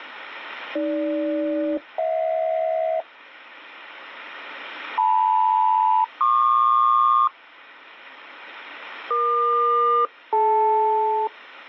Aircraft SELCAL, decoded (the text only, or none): AG-HJ LM-PQ EQ-DL